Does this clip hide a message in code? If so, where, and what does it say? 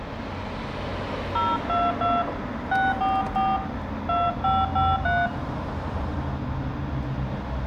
Yes: DTMF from 1.4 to 5.3 s, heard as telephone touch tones, dialled by hand, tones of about 210 ms, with room echo and the noise of a residential street. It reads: 022 644 2553